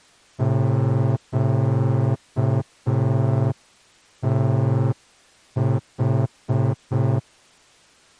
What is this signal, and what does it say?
Morse code, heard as a horn, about 5 wpm. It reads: QTH